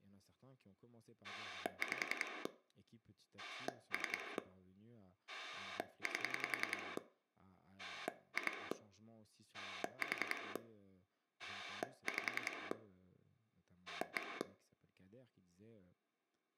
Pulse dialling, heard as a rotary dial, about 10 pulses a second, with speech in French. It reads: 5 3 8 2 4 5 1